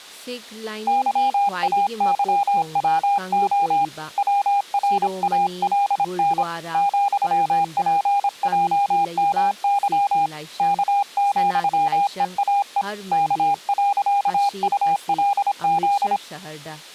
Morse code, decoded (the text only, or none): YAYWO WRALN ,PJMY K,EAE K.ULZ